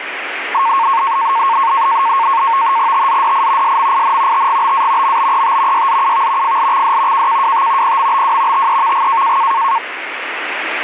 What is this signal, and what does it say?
NAVTEX (SITOR-B), 100 baud, 170 Hz shift, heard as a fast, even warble, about 1000 Hz centre, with radio static. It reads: TZDI SMIN TGBA MBET YZUV FLXD KKWT PMBW TEVG